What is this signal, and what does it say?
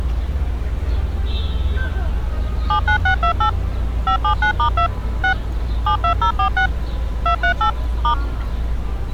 DTMF, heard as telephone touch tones, dialled by machine, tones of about 90 ms, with street noise. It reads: 79628 579*2 6 72046 238 *